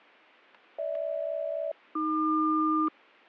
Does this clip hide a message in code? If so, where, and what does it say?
Yes: aircraft SELCAL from 0.8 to 2.9 s, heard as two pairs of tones, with static crashes. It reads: GH-AQ